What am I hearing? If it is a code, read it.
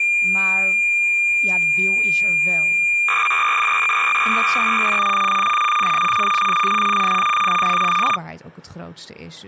Cassette data (Kansas City type), 300 baud, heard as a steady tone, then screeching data, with speech in Dutch.